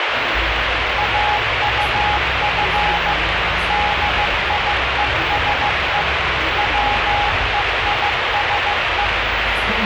Morse code, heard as a keyed tone, machine-sent, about 15 wpm, 830 Hz, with heavy radio static and the noise inside a bus. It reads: AUF DIESE WEISE